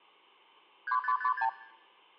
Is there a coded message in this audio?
Yes: multi-frequency trunk signalling (R2, with the far end's replies) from 0.9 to 1.5 s, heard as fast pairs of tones, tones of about 80 ms, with room echo. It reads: 3556